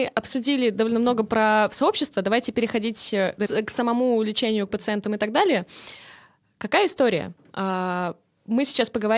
Speech in Russian. There is no code.